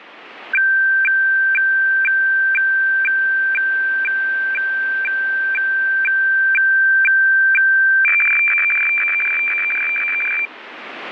Weather fax (radiofax), 120 lines a minute, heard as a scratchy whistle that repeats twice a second, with radio static.